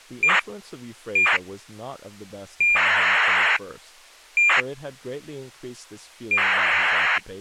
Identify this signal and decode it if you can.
ACARS aircraft data, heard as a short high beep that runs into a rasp, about 2400 baud, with speech in English.